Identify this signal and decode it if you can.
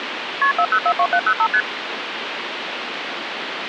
Multi-frequency trunk signalling (R1, as on North American trunks), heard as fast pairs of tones, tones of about 70 ms, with phone line noise. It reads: KP 4042705 ST